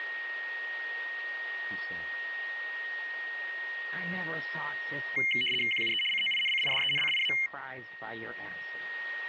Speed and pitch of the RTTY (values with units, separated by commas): 75 baud, 850 Hz shift, 2550 Hz centre